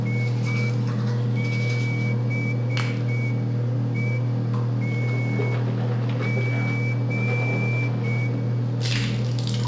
Morse code, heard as a whistle, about 6 wpm, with room echo and the noise of a restroom. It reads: IBETG